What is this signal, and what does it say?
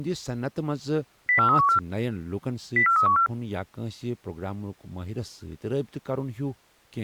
Five-tone selective call (CCIR), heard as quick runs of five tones, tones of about 100 ms, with speech in Kashmiri. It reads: 04314 04314